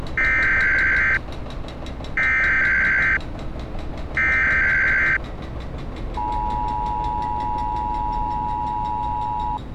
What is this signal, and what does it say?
Emergency Alert System (SAME) tones (header bursts, then the 853 and 960 Hz attention tone), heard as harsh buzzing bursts, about 520.83 baud, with street noise.